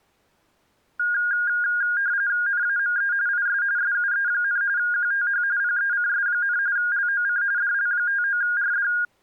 RTTY (45.45 baud, 170 Hz shift), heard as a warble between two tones, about 1550 Hz centre. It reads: NAME IS SUE, QTH PECS, LOC DL59RD